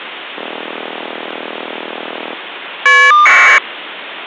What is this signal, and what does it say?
Caller ID data burst, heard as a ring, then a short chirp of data, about 1200 baud.